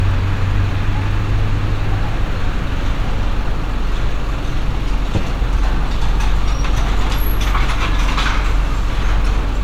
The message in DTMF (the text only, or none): none